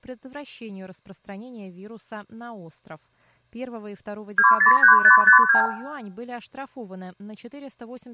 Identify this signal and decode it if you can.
Multi-frequency trunk signalling (R2, with the far end's replies), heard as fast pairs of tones, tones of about 110 ms, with room echo and speech in Russian. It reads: 203552